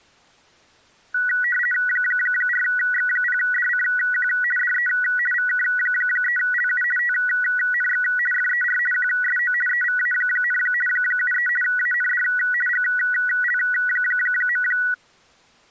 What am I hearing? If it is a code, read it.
RTTY (50 baud, 450 Hz shift), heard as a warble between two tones, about 1700 Hz centre. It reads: 4X0DCQ DE VK3LU TNX FER QSO EVA, 73 AND GL.